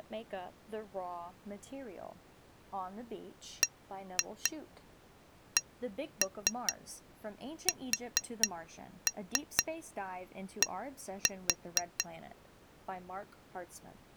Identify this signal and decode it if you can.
Tap code, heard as taps on glass, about 4 knocks a second, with speech in English. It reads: BCSD